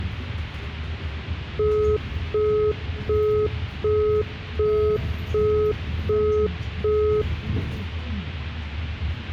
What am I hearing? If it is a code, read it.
Telephone call progress tone (as in the UK, Australia and similar networks), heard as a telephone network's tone, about 420 Hz, 0.375 s on and 0.375 s off, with the noise inside a bus. Busy tone.